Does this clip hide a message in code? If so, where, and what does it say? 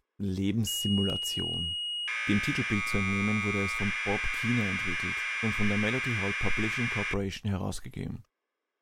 Yes: Commodore tape loading (standard loader) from 0.7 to 7.1 s, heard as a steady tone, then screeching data, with speech in German.